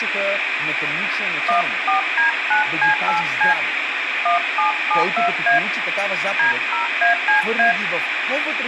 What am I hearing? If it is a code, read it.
DTMF, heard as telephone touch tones, dialled by hand, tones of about 120 ms, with radio hiss, room echo and speech in Bulgarian. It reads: 14D9C8C 1772A D0ACA